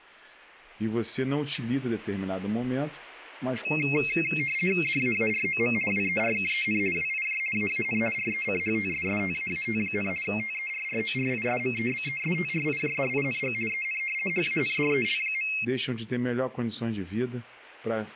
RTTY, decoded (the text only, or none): DAAROM WERKEN WIJ AAN RECHTSSTAAT, TERRORISMEBESTRIJDING EN HANDEL.